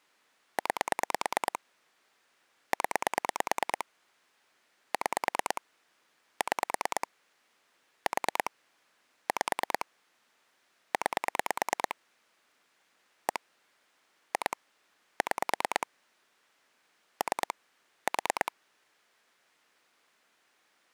Pulse dialling, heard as clicks on a phone line, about 9 pulses a second. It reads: 9 0 6 6 4 5 9 1 2 6 3 4